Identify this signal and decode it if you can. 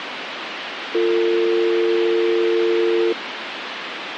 Telephone call progress tone (North American or UK plan), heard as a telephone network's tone, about 350, 450 Hz, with phone line noise. Dial tone.